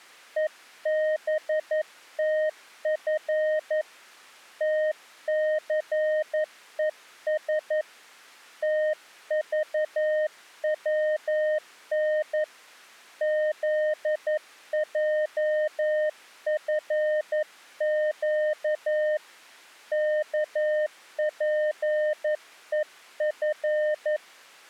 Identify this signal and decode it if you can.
Morse code, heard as a keyed tone, hand-sent with a paddle, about 11 wpm, 610 Hz. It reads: EBTF TCES TVWN ZJFQ KPEF